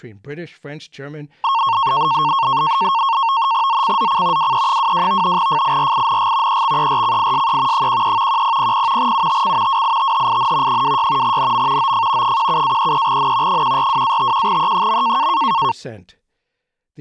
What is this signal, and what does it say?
NAVTEX (SITOR-B), 100 baud, 170 Hz shift, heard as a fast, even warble, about 1000 Hz centre, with speech in English. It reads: ZCZC WE22 FIRING EXERCISE 13 1000 UTC WITHIN 26 NM OF 17-33N 142-51E.